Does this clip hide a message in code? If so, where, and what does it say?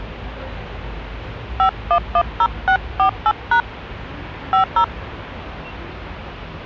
Yes: DTMF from 1.6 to 4.8 s, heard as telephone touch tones, dialled by hand, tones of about 80 ms, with the noise of a residential street. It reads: 5110648# 50